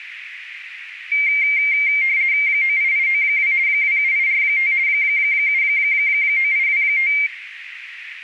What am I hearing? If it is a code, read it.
RTTY (50 baud, 170 Hz shift), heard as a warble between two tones, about 2200 Hz centre, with radio static and a narrow filter. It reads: 98892 27845 79825